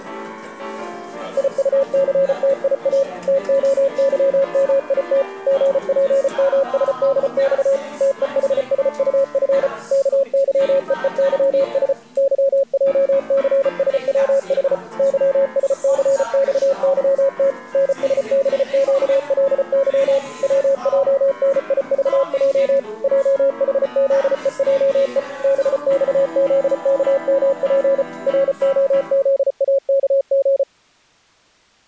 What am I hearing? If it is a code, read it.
Morse code, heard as a keyed tone, machine-sent, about 34 wpm, 550 Hz. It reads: IUCTIA TOYMIT GPMSDX TEHSUF KYEEYS YJCSWH YSCXYT NSBQLY WJNIVJ JHZEJE BXZKMP ROZAKG